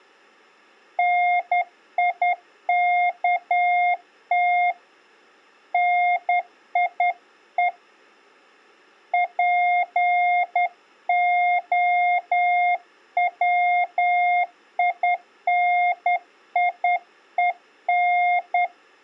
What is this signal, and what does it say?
Morse code, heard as a keyed tone, hand-sent with a straight key, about 10 wpm, 710 Hz. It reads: NIKT NIE POWINIEN